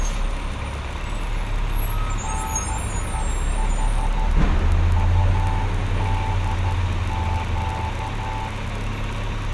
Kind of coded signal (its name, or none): Morse code